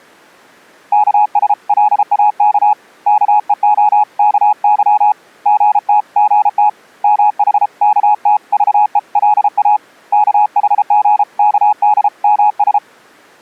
Morse code (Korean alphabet), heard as a keyed tone, hand-sent with a paddle, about 33 wpm, 840 Hz. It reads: 여공 앞에 서서 무어라고 웃으며